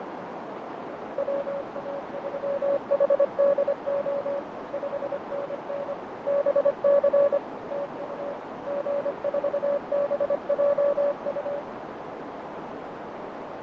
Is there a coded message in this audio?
Yes: Morse code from 1.1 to 11.7 s, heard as a keyed tone, machine-sent, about 25 wpm, 570 Hz, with heavy radio static, fading and a narrow filter. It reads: WA3HDO 5NN BC TU G4BJU